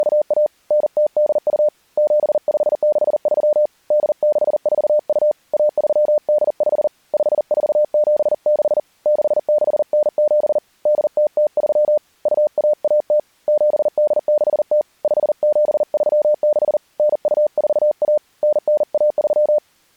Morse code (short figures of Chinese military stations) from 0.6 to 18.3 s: 9082 7563 8642 1385 5476 6697 8003 2110 7860 5736 9241

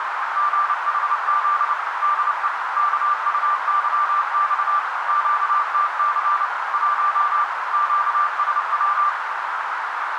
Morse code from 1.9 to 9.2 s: DE KUYX QTC 1 QSW

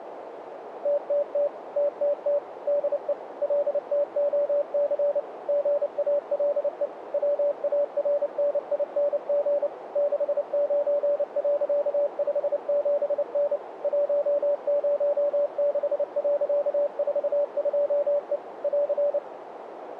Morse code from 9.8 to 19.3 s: 69.57N 106.42E <AR>

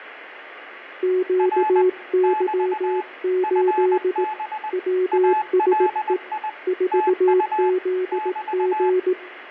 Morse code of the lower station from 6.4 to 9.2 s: 4ZG

